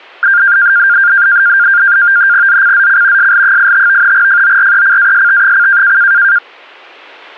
NAVTEX (SITOR-B), 100 baud, 170 Hz shift, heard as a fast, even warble, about 1500 Hz centre. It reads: ZCZC SL85 FORECAST: